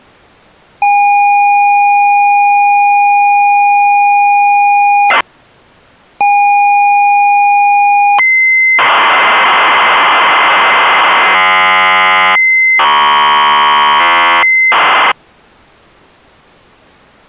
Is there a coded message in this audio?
Yes: ZX Spectrum tape loading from 0.8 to 15.1 s, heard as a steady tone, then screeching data.